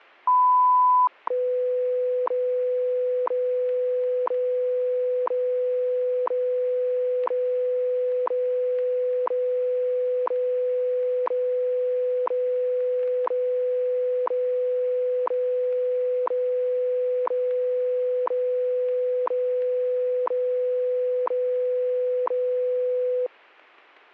Radio time signal (WWV, Colorado), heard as ticks, one a second, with static crashes.